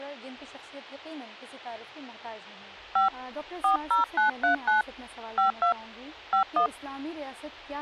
DTMF, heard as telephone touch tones, dialled by hand, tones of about 120 ms, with a squelch burst at the end. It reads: 5 40939 52 51